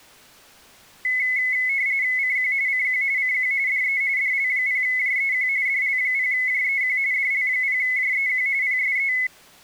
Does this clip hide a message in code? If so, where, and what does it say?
Yes: RTTY (45.45 baud, 170 Hz shift) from 1.0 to 9.3 s, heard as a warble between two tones, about 2100 Hz centre. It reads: CQ CQ CQ DE DL0JEQ DL0JEQ DL0JEQ PSE